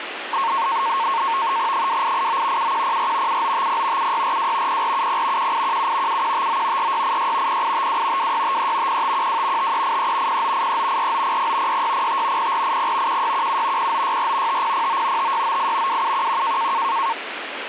NAVTEX (SITOR-B), 100 baud, 170 Hz shift, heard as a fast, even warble, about 1000 Hz centre, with radio static. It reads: 2889 7104 7950 7642 0470 1817 7159 4686 0852 2653 0512 5383 0983 4900 6605 0480 1617 0964 5009 5698 2711